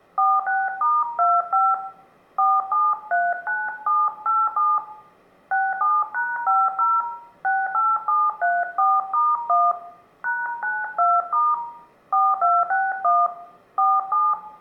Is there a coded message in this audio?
Yes: DTMF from 0.2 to 14.3 s, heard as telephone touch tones, dialled by hand, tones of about 220 ms, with room echo. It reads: 46*25 4739787 67#50 68734*1 #92* 4261 47